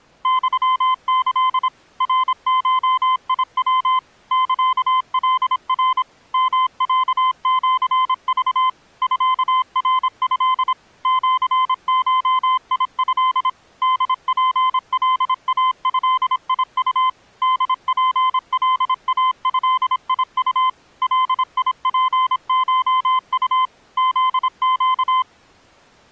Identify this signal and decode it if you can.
Morse code (Japanese Wabun code), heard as a keyed tone, machine-sent, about 26 wpm, 1030 Hz. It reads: ユキ ナゴヤ サカナ ヨロシク ミナト シゴト ホツカイドウ ホツカイドウ ガツコウ フネ